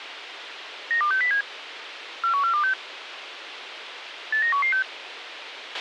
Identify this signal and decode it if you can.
Five-tone selective call (CCIR), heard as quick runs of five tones, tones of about 100 ms, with radio hiss and a squelch burst at the end. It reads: 92607 41426 89116